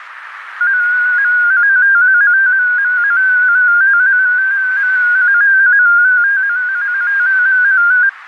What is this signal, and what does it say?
Multi-tone FSK (Olivia or MFSK type), about 250 Hz wide, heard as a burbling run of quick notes, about 15.625 baud, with radio static and a narrow filter.